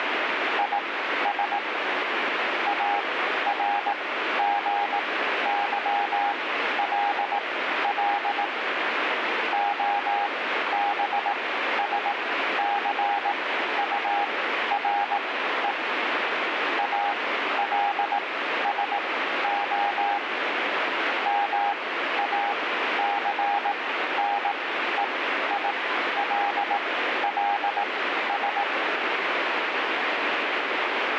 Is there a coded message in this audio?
Yes: Morse code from 0.5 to 28.7 s, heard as a keyed tone, machine-sent, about 18 wpm, spaced as for 12 wpm, 810 Hz, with radio static. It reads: IS ARGYLL OBSCURE ALSO MACNEILLS